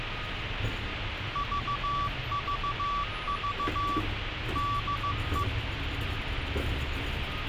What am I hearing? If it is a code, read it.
Morse code, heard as a keyed tone, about 15 wpm, 1150 Hz, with radio hiss and street noise. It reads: VVV DE